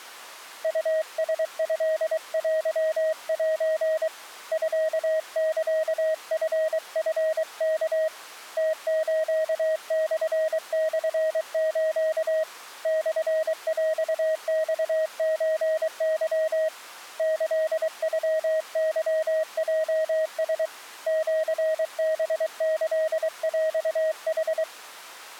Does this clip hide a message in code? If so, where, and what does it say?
Yes: Morse code (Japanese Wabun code) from 0.6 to 24.7 s, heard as a keyed tone, hand-sent with a paddle, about 23 wpm, 630 Hz. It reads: ウラトテセ ミサチチワ ムスモモス モヰマソケ キノケヲラ シハキヰヌ